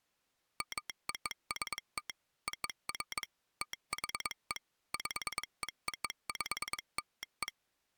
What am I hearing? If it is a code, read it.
Morse code (American railroad code), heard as a telegraph sounder, machine-sent. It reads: MOST OF THE PEOPLE